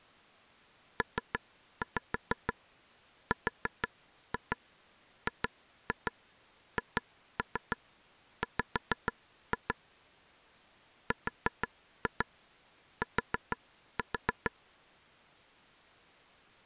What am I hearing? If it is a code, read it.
Tap code, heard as taps on a table, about 6 knocks a second. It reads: PRGHW RT